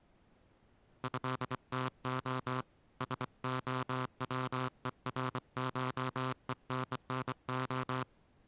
Morse code (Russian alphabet), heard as a buzzer, hand-sent with a bug key, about 24 wpm. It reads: ЭТО СОВЕРШЕННО